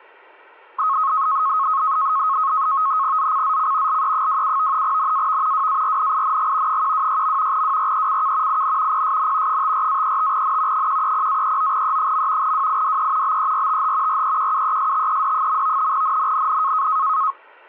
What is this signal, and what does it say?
NAVTEX (SITOR-B), 100 baud, 170 Hz shift, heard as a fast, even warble, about 1180 Hz centre. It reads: ZCZC LE27 NAV WARNING 126. WRECK IN PSN 54-35N 130-39E. WIDE BERTH REQUESTED. NNNN